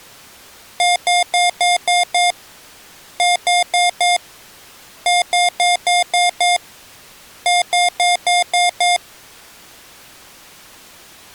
Beep code, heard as beeps from a small speaker, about 710 Hz. 6-4-6-6.